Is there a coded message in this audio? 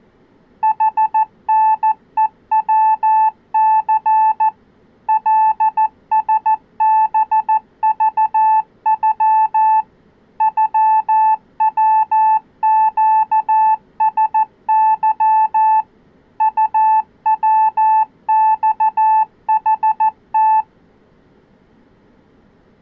Yes: Morse code (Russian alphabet) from 0.6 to 20.7 s, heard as a keyed tone, machine-sent, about 14 wpm, 870 Hz. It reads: ХНЕВЦ ЛСБЖЮ ЮВЩСЫ УВЬХТ